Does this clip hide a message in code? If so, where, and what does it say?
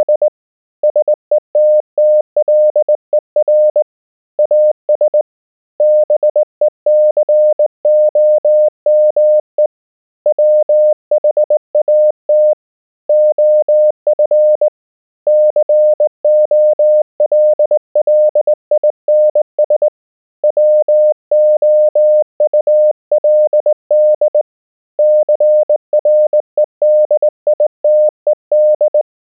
Yes: Morse code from 0.0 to 29.1 s, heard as a keyed tone, hand-sent with a straight key, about 19 wpm, 610 Hz. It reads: … SETTLER AS BECOME WHAT OF COLLINS WOULD CREDITED